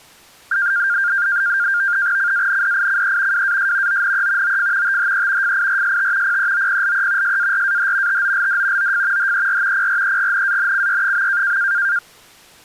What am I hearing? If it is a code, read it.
NAVTEX (SITOR-B), 100 baud, 170 Hz shift, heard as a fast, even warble, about 1500 Hz centre. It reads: CANDICE WAS ONE OF THE FIRST PEOPLE SARAH TOLD OF HER PREGNANCY.